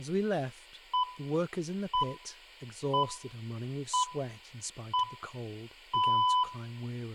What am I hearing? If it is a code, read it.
Radio time signal (six pips, as the Greenwich Time Signal), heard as pips, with room echo and speech in English.